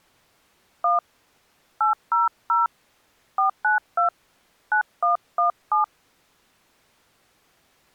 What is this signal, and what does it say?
DTMF, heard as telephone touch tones, dialled by hand, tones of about 130 ms. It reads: 1 800 492 9117